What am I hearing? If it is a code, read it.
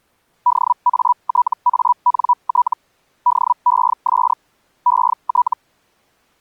Hellschreiber (Feld-Hell, 122.5 baud), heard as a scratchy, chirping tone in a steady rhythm, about 980 Hz. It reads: DATANT DES ET